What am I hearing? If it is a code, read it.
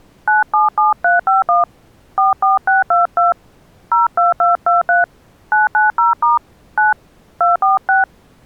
DTMF, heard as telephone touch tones, dialled by hand, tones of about 150 ms. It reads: 977351 44622 02223 990* 9 246